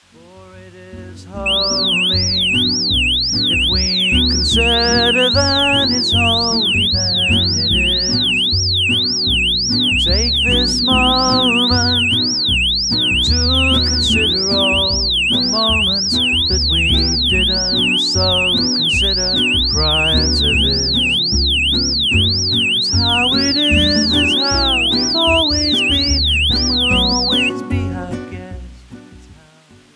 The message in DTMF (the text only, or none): none